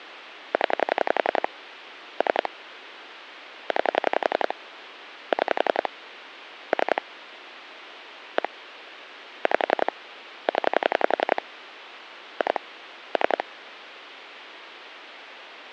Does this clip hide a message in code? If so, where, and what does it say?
Yes: pulse dialling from 0.5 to 13.4 s, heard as clicks on a phone line, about 11 pulses a second, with phone line noise. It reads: 0 3 9 6 3 1 5 0 2 3